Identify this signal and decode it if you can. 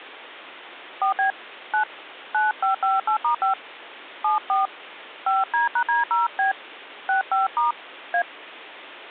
DTMF, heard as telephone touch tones, dialled by hand, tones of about 140 ms. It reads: 4B 9 9558*5 74 5D#D0B 65* A